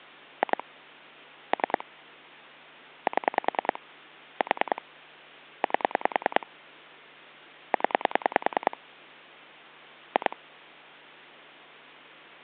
Pulse dialling, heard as clicks on a phone line, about 10 pulses a second. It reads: 2 3 7 4 8 0 2